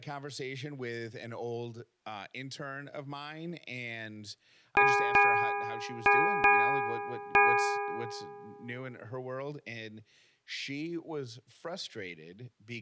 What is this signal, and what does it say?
Ship's bell, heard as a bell, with speech in English. 5. Five half-hours of the watch have passed.